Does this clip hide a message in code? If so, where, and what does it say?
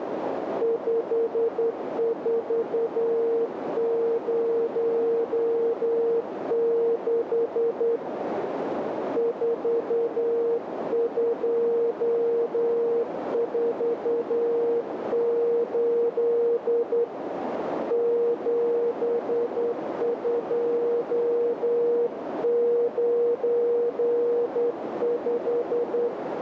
Yes: Morse code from 0.6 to 26.1 s, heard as a keyed tone, hand-sent with a straight key, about 10 wpm, 470 Hz, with radio static and a narrow filter. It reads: 5406 4248 7295